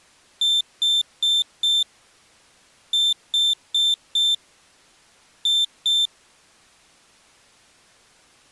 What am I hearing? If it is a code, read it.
Beep code, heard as a piezo beeper, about 3550 Hz. 4-4-2. In Phoenix BIOS tables: parallel port failure.